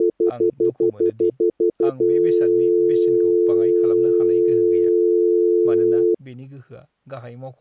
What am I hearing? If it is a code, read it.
Telephone call progress tone (North American plan), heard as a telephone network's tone, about 350, 440 Hz, 0.1 s on and 0.1 s off, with speech in Bodo. Stutter dial tone.